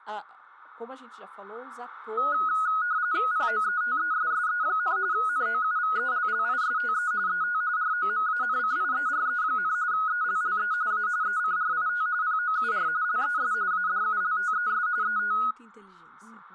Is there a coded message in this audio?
Yes: RTTY (45.45 baud, 170 Hz shift) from 2.2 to 15.5 s, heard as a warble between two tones, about 1360 Hz centre, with speech in Portuguese. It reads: POETESSE, NOUVELLISTE ET ROMANCIERE, ELLE A ECRIT POUR LES ADULTES ET